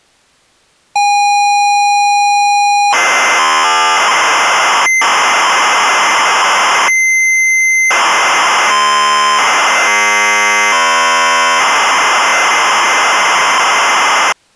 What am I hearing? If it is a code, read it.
ZX Spectrum tape loading, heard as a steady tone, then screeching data.